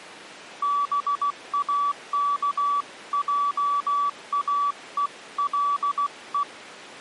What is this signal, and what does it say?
Morse code (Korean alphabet), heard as a keyed tone, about 16 wpm, 1150 Hz. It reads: 동화가